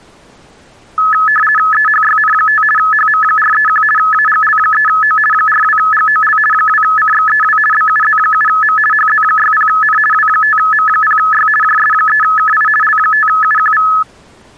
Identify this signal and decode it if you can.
RTTY (50 baud, 450 Hz shift), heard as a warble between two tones, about 1500 Hz centre. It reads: EHYN5 HM431 AGL3O 42GOL 2CXEW BUZ7M HZ60N W5M0Y JS3KI L5UQV